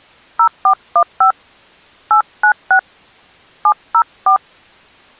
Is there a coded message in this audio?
Yes: DTMF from 0.4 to 4.4 s, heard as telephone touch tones, dialled by hand, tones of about 90 ms. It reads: 0415 896 704